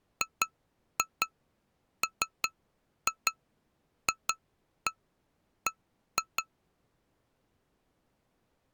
Tap code, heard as taps on glass, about 5 knocks a second. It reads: GMFB